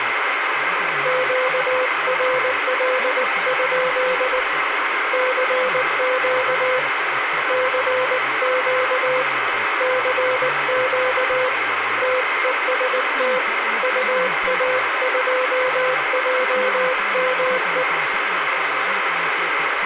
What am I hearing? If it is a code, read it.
Morse code, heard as a keyed tone, hand-sent with a paddle, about 19 wpm, 510 Hz, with radio static and speech in English. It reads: QRL? CQ CQ CQ TEST UA2JME